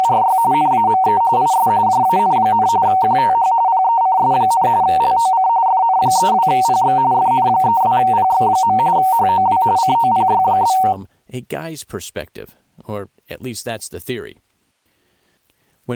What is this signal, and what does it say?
RTTY (45.45 baud, 170 Hz shift), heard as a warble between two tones, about 840 Hz centre, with speech in English. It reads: … NAME IS JAN, QTH PECS, LOC FN32PX FN32PX. HOW COPY?